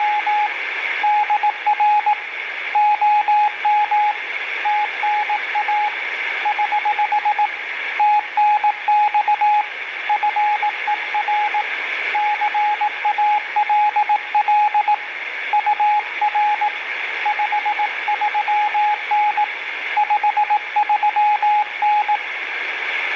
Morse code, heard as a keyed tone, hand-sent with a paddle, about 18 wpm, 840 Hz, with radio static. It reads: … DR OM TNA <HH> TNX FER CALL UR 53N 53N